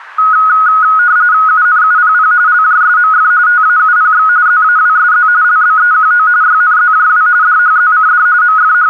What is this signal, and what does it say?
RTTY (45.45 baud, 170 Hz shift), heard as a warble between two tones, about 1360 Hz centre. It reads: UNUPP LJSMF TAUPX ZAWSZ LBEQO YNZJW DHZCD …